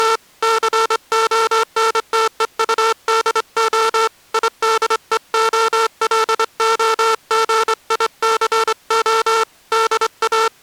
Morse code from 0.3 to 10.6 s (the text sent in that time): CONTEUDO IDEOLOGICO …